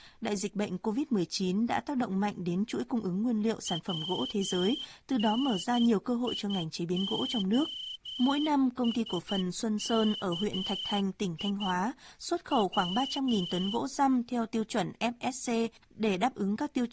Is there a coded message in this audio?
Yes: Morse code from 3.6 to 13.8 s, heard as a whistle, hand-sent with a straight key, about 11 wpm, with speech in Vietnamese. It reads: WNIOSKI W